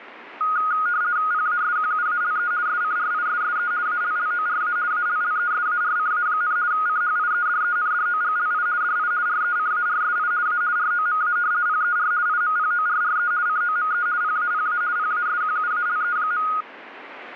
RTTY (50 baud, 170 Hz shift), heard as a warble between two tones, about 1340 Hz centre, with radio static. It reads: PASQUALE SCRISSE ALLORA ALLESARCA, CHIEDENDOGLI DI RECARSI A ROMA PER IMPORRE COME PAPA PASQUALE.